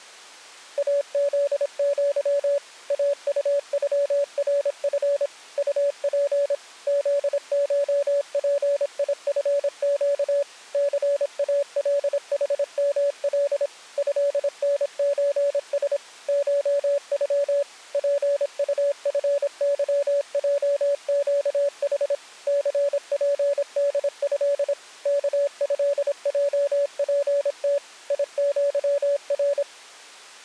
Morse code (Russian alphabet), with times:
0.8-2.6 АЗЪ
2.9-5.3 АУЮРФ
5.6-6.5 УП
6.9-10.4 ЗШПИФЩ
10.7-13.7 ЦАЛХМЛ
14.0-16.0 ЭНЧС
16.3-17.6 ШЮ
17.9-22.1 ПУФЫЙЩХ
22.5-24.7 ЦПДЭ
25.1-27.8 КЭЙПТ
28.1-29.6 ИЪР

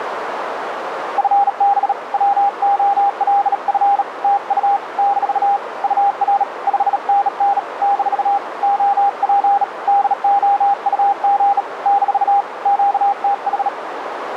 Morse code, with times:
1.2-1.9 FB
2.1-4.0 WOLF
4.2-4.8 TU
5.0-5.6 -
5.8-6.4 UR
6.7-7.6 5NN
7.8-8.4 -
8.6-9.6 OP
9.9-11.6 DOUG
11.9-12.4 -
12.7-13.7 QTH

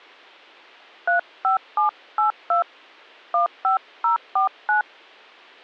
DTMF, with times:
1.1-2.6 35782
3.3-4.8 15049

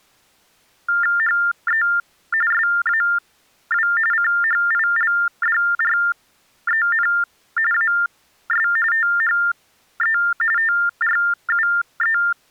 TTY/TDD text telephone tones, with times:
1.2-1.8 HE
2.5-3.9 SAW
4.1-7.1 CHILDREN
7.7-8.7 AS
8.9-10.2 THE
10.6-12.2 TRUE

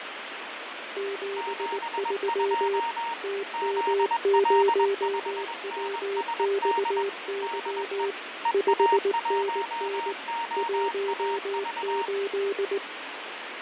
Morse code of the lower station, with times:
1.0-2.8 73
3.2-8.1 TM0WXY
8.5-10.1 5NN
10.6-12.8 18

